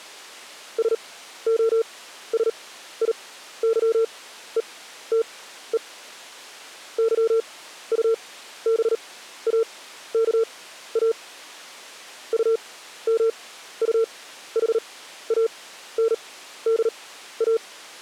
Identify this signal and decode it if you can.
Morse code, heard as a keyed tone, machine-sent, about 38 wpm, spaced as for 14 wpm, 450 Hz. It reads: SOSIYETE YUBAKA UMUHANDA